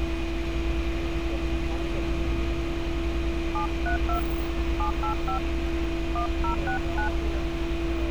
DTMF, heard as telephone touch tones, dialled by hand, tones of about 110 ms, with street noise. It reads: 732 785 1069